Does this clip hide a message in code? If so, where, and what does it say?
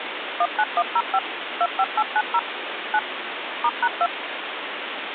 Yes: DTMF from 0.4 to 4.1 s, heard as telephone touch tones, dialled by machine, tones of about 50 ms, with phone line noise. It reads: 19105 25890 9 *#2